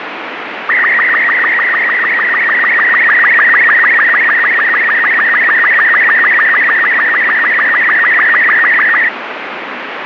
SSTV (slow-scan television), Robot 36, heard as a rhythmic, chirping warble, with radio static.